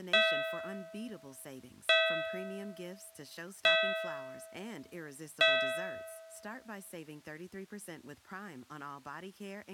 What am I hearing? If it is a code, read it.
Clock strike, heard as a bell, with speech in English. 4. Four o'clock.